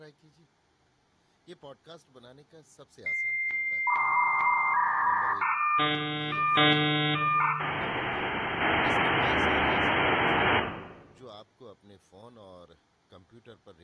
Dial-up modem handshake (V.34 or later), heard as a whistle, warbles, then hiss, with room echo and speech in Urdu.